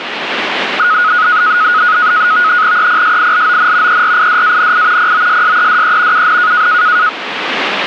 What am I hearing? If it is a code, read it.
NAVTEX (SITOR-B), 100 baud, 170 Hz shift, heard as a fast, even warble, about 1360 Hz centre, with radio static. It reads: EPSILON ERIDANI POSSEDE UN